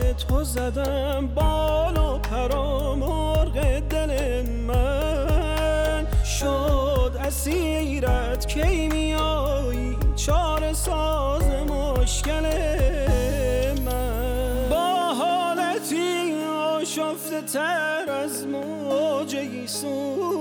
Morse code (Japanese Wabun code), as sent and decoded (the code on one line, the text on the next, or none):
none